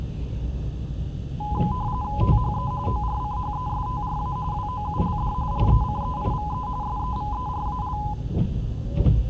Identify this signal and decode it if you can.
RTTY (45.45 baud, 170 Hz shift), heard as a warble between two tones, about 920 Hz centre, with the noise inside a car. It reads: THE ORCHESTRA WOULD RECEIVE SEVERAL